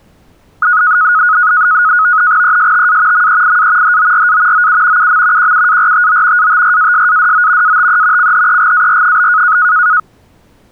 NAVTEX (SITOR-B), 100 baud, 170 Hz shift, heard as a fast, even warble, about 1360 Hz centre. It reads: ESTA MEIA HORA OU UM QUARTO ATRASADO ATE CHEGAR?